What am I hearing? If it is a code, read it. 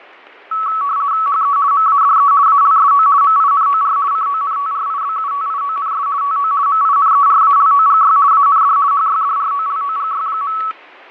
RTTY (50 baud, 170 Hz shift), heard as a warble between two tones, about 1220 Hz centre, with fading and static crashes. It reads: HE MADE ALSO MINOR CONTRIBUTIONS TO MINERALOGY AND HYDROLOGY.